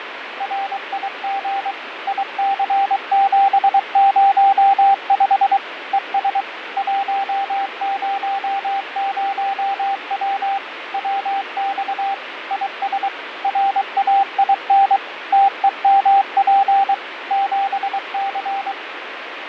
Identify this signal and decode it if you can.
Morse code, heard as a keyed tone, machine-sent, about 23 wpm, 790 Hz, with radio static and fading. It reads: RIG IC705 ES 100W WX IS RAIN TEMP 7C